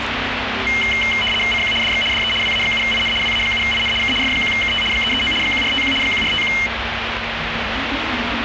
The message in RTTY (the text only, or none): CQ DX DE WA7IN WA7IN K F1KT 339 1451 1451